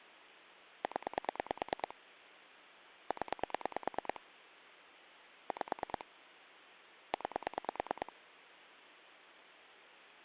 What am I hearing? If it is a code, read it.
Pulse dialling, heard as clicks on a phone line, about 9 pulses a second. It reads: 0 0 5 9